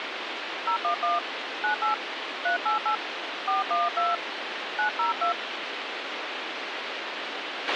DTMF, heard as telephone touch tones, dialled by hand, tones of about 140 ms, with radio hiss and a squelch burst at the end. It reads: 011 98 388 412 902